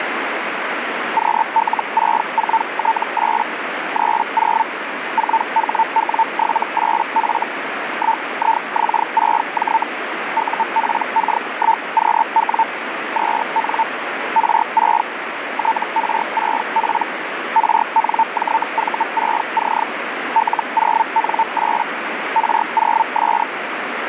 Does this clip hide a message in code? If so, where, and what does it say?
Yes: Hellschreiber (Feld-Hell, 122.5 baud) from 1.2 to 23.4 s, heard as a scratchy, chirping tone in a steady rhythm, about 900 Hz, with radio static. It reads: QL64T8 30 4HW78F 1IX6J UPK1QW 2N R6 TR6P RNJV6C L0N8 R0S